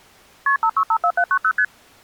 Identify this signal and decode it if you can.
Multi-frequency trunk signalling (R1, as on North American trunks), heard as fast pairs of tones, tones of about 70 ms. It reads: KP 5654790 ST